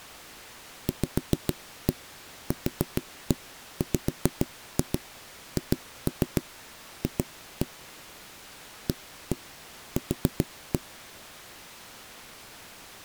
Tap code, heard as knocks on wood, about 7 knocks a second. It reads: VQWHF AQ